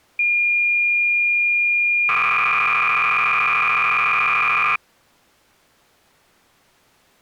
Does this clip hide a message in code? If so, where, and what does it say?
Yes: cassette data (Kansas City type), 300 baud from 0.2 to 4.8 s, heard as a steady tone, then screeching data.